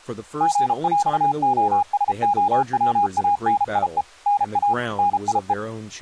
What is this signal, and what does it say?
Morse code (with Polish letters), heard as a keyed tone, machine-sent, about 33 wpm, 820 Hz, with speech in English. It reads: GŁOSOWANIE NA NIE